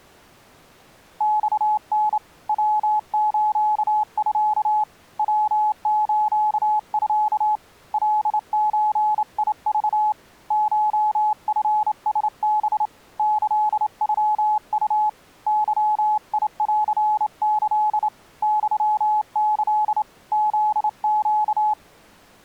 Morse code (Japanese Wabun code), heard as a keyed tone, hand-sent with a straight key, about 28 wpm, 850 Hz. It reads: マタ ヤスミ ヤスミ カゾク コチラハ キノウ ゲンキ ユキ フネ